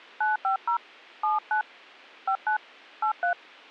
DTMF, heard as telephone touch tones, dialled by hand, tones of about 120 ms, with a squelch burst at the end. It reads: 950 79 59 83